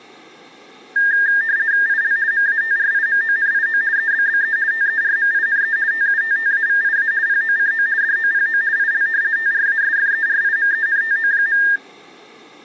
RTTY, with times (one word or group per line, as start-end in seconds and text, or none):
1.9-2.2 IL
2.3-3.8 MATRIMONIO
4.0-4.6 EBBE
4.7-5.8 TERMINE
5.9-7.1 TUTTAVIA
7.3-7.9 POCO
8.0-8.6 DOPO
8.8-9.1 IL
9.4-11.6 TRASFERIMENTO.